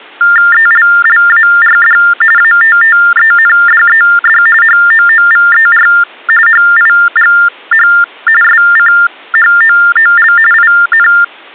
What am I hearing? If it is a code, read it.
TTY/TDD text telephone tones (45.45 baud Baudot), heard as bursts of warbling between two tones, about 400 Hz shift, 1600 Hz centre. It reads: ELLARD ATTENDED HOOVER HIGH SCHOOL IN